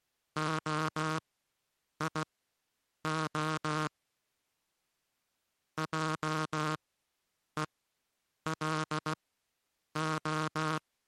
Morse code (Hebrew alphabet), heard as a buzzer, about 16 wpm, spaced as for 8 wpm. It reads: היה עולה